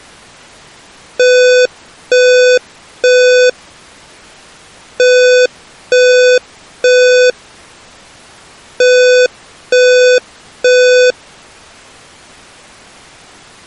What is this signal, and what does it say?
Alarm pattern, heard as an alarm's beeps, played three times, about 500 Hz. Temporal three. Smoke or fire, evacuate.